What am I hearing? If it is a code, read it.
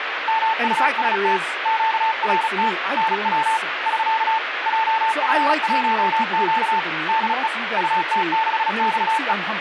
Morse code, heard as a keyed tone, hand-sent with a paddle, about 36 wpm, 890 Hz, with radio static and speech in English. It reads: MUST QRT NW <SK> JF1Q DE UT6XE